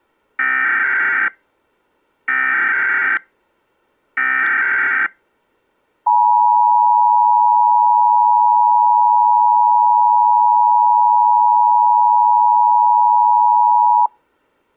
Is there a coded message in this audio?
Yes: Emergency Alert System (SAME) tones (header bursts, then the 853 and 960 Hz attention tone) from 0.4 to 14.1 s, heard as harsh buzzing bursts, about 520.83 baud.